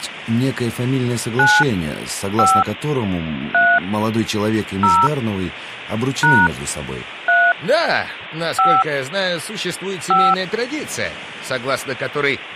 DTMF, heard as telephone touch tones, dialled by hand, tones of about 240 ms. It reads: 9 5 3 0 # 3 5 5